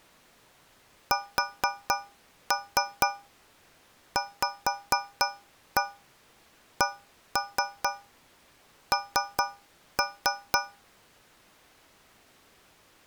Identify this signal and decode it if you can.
Tap code, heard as taps on a metal pipe, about 4 knocks a second. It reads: SVCN